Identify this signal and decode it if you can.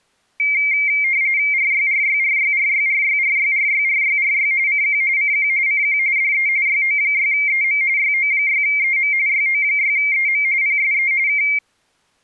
RTTY (45.45 baud, 170 Hz shift), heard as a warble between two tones, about 2200 Hz centre. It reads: RYRYRYRYRYRYRYRYRY CQ CQ CQ DE YO6EM YO6EM YO6EM PSE K